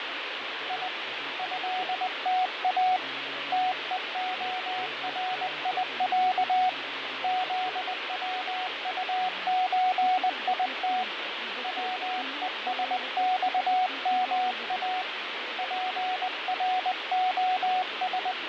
Morse code (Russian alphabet), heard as a keyed tone, hand-sent with a paddle, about 20 wpm, 740 Hz, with radio static and fading. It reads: И ЭТА ТЕОРИЯ ЗВУЧИТ ВЕСЬМА …